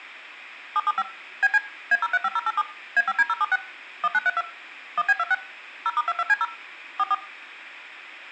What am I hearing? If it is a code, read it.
DTMF, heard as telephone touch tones, dialled by machine, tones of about 40 ms, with room echo. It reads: 775 BC A035087 A5D076 1932 1B26 0*22C0 44